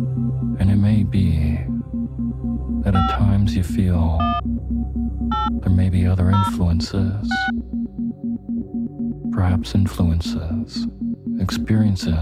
DTMF, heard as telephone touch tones, dialled by hand, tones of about 200 ms. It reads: 5 1 8 0 6